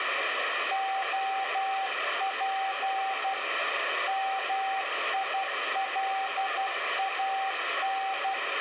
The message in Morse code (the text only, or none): OP MILAN